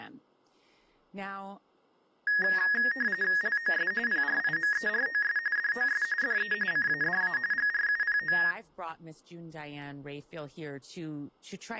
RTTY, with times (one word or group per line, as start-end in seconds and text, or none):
3.4-3.9 LOS
4.1-5.4 PRIMEROS
5.6-6.0 DOS
6.2-6.5 DE
6.7-7.4 CADA
7.5-8.4 GRUPO